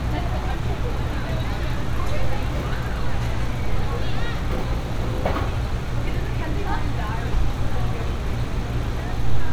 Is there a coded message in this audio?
No, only street noise.